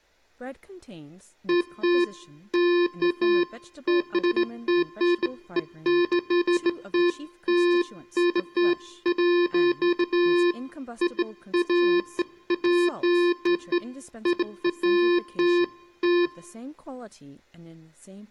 Beeps of irregular length, with speech in English. There is no code.